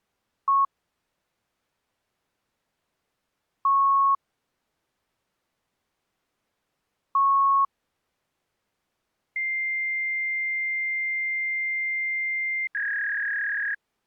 Fax machine handshake, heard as beeps, a long tone and a warble.